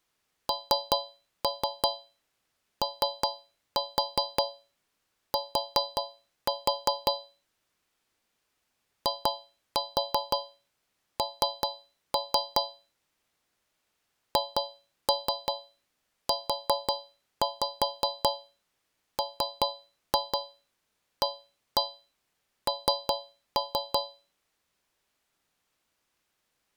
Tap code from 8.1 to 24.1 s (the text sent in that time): IN HUMAN